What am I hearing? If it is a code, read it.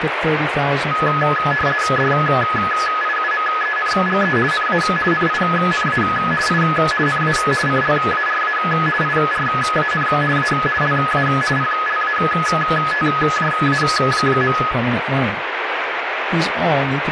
RTTY (50 baud, 450 Hz shift), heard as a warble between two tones, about 1480 Hz centre, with radio static and speech in English. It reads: DIUMENGE NA NINA I NA CLARA IRAN A LA PLATJA.